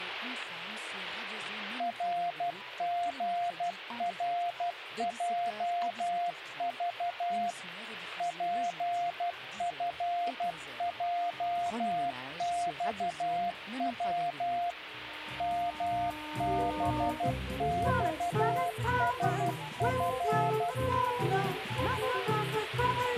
Morse code, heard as a keyed tone, machine-sent, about 12 wpm, 700 Hz, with radio static. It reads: RGRJV PFJXW MBXSF